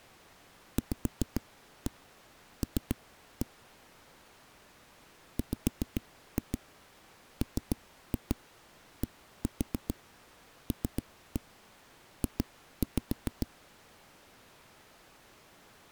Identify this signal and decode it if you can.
Tap code, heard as knocks on a wall, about 6 knocks a second. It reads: VL WMDLJ